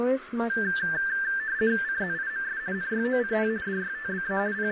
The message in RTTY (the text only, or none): CZIMS NYOCP DYTBA …